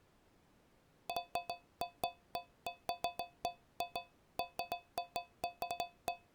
Irregular taps on a metal pipe. There is no code.